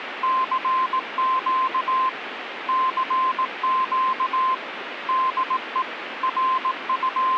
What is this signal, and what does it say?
Morse code, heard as a keyed tone, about 18 wpm, 1040 Hz, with radio static. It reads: CQ CQ DE …